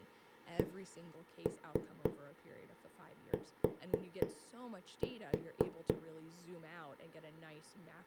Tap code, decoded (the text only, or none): CT